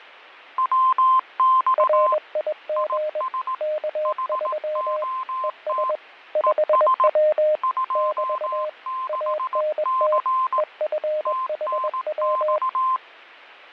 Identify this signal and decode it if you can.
Morse code, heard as two keyed tones, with radio static and fading. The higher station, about 18 wpm, 1040 Hz: WX IS HOT ES 26C TNX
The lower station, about 21 wpm, 610 Hz: RIG K3 ES 5W <BT> ANT EFHW